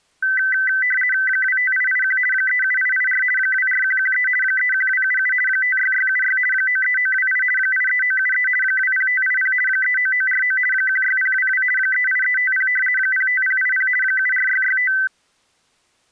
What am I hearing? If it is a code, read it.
RTTY (50 baud, 450 Hz shift), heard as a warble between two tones, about 1750 Hz centre. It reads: 25881 37884 24113 31277 56676 93928 83973 20580 39949 16022 38350 05080 74665